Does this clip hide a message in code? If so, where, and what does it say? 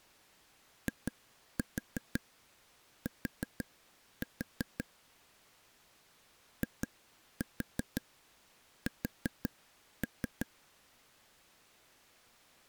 Yes: tap code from 0.9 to 10.5 s, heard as taps on a table, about 5 knocks a second. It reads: IT IS